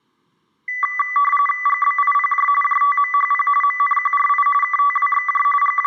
RTTY (45.45 baud, 850 Hz shift), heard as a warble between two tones, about 1550 Hz centre. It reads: GBIPJ JTMHP MNQRI KTWXJ …